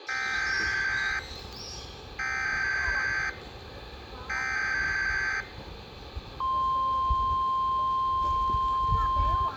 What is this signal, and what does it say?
Emergency Alert System (SAME) tones (header bursts, then the 1050 Hz attention tone), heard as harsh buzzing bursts, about 520.83 baud, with the noise of a park.